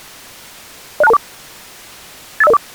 Five-tone selective call (EIA), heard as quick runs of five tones, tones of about 30 ms. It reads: 06224 85004